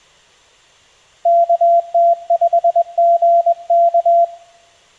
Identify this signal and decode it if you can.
Morse code, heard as a keyed tone, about 21 wpm, 680 Hz, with room echo. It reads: KT5GK